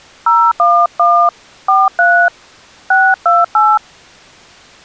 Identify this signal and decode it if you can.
DTMF, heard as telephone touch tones, dialled by hand, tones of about 260 ms. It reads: 011 43 628